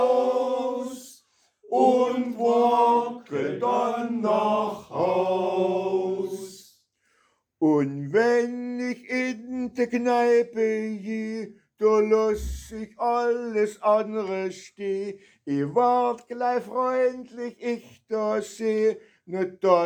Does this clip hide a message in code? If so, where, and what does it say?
No.